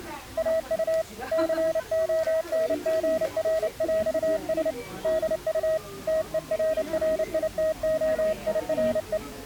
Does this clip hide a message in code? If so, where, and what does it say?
Yes: Morse code (with French letters) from 0.3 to 9.2 s, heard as a keyed tone, hand-sent with a paddle, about 29 wpm, 640 Hz, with the noise of a crowd indoors. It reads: AU CONGRÈS DU TERRITOIRE